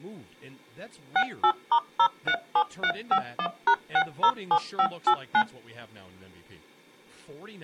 DTMF, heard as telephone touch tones, dialled by machine, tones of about 70 ms, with speech in English. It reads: 68*037351#607589